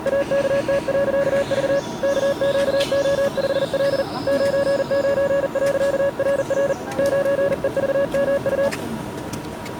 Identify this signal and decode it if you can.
Morse code, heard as a keyed tone, hand-sent with a paddle, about 40 wpm, 560 Hz, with the noise of a park. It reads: AKT.V KQO5L 99.RR 9EVMU